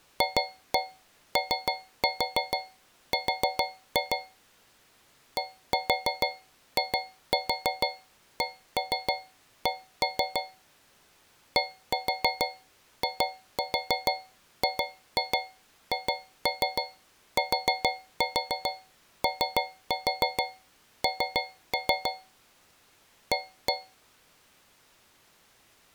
Tap code, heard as taps on a metal pipe, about 6 knocks a second. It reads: FOR DICK DIGHTON A